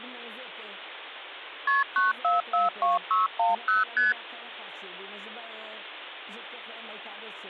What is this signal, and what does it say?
Multi-frequency trunk signalling (R1, as on North American trunks), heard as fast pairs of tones, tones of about 160 ms, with phone line noise. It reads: KP 9442610 ST